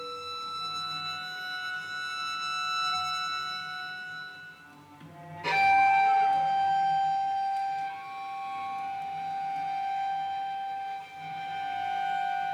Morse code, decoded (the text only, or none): none